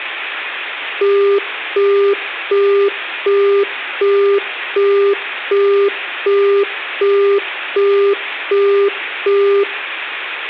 Telephone call progress tone (as in the UK, Australia and similar networks), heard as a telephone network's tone, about 400 Hz, 0.375 s on and 0.375 s off, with hum. Busy tone.